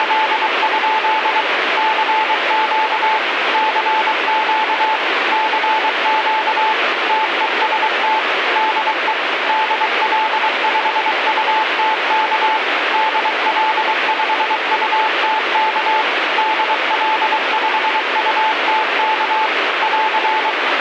Morse code, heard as a keyed tone, machine-sent, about 23 wpm, 870 Hz, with radio static. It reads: … CQ CQ CQ TEST DE DL5UTK DL5UTK DL5UTK <AR>